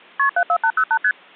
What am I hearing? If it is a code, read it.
Multi-frequency trunk signalling (R1, as on North American trunks), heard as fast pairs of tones, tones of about 70 ms. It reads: KP 74808 ST